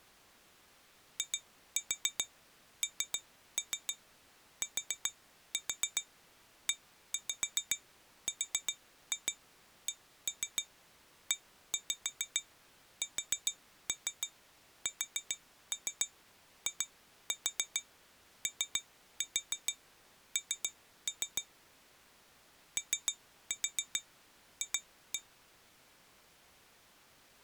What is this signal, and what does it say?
Tap code, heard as taps on glass, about 7 knocks a second. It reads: INTERCESSION OF